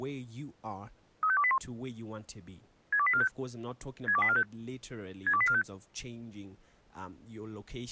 Five-tone selective call (ZVEI), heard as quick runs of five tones, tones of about 70 ms, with speech in English. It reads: 35281 62845 62845 62845